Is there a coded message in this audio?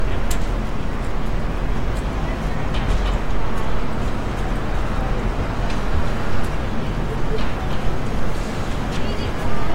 No, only street noise.